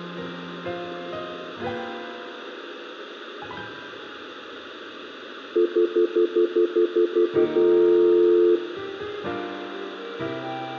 Telephone call progress tone (North American plan), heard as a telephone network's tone, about 350, 440 Hz, 0.1 s on and 0.1 s off, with phone line noise and room echo. Stutter dial tone.